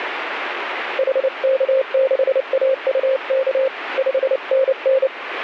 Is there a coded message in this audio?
Yes: Morse code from 0.9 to 5.1 s, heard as a keyed tone, hand-sent with a paddle, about 29 wpm, 530 Hz, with radio static. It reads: HK6AUK 5NN